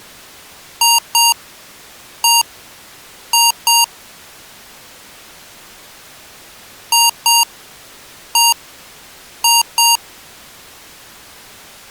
Beep code, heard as beeps from a small speaker, played twice, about 930 Hz. 2-1-2.